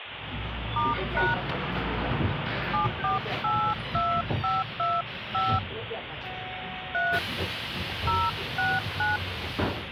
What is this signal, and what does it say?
DTMF, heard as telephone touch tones, dialled by hand, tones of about 220 ms, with phone line noise and the noise inside a bus. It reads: *# 7482525 3 069